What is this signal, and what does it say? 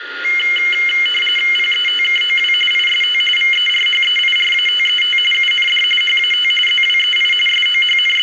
RTTY (45.45 baud, 850 Hz shift), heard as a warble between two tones, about 2550 Hz centre, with radio static, a steady whistle near 1420 Hz and room echo. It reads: PETKOW IST VERHEIRATET UND HAT ZWEI …